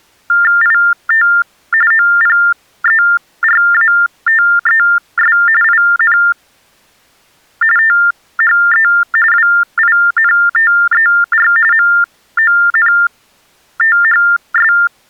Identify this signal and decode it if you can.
TTY/TDD text telephone tones (45.45 baud Baudot), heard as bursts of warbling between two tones, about 400 Hz shift, 1600 Hz centre. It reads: IT OPERATES IN THE WINTER MONTHS